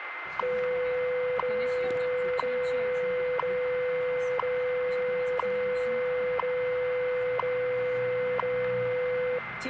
Radio time signal (WWV, Colorado), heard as ticks, one a second, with radio static, a steady whistle near 2080 Hz and the noise inside a car.